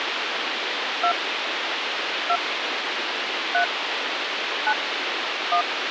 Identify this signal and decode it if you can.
DTMF, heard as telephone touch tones, dialled by hand, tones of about 80 ms, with radio hiss. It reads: 2 2 3 9 1